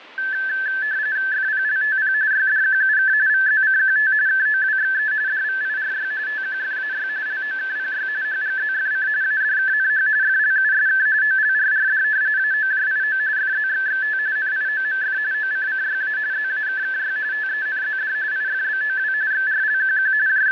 RTTY (45.45 baud, 170 Hz shift), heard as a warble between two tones, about 1650 Hz centre, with radio static. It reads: FPLTP YDQUK VZCQT KOWXE DVIRY TQFAY LOKPY HGZFC ADKNH FLUSK OLRRD AOJIO FZXXT NIOMF OCCYA ZAKKY TENZD IFBOW XRLQQ …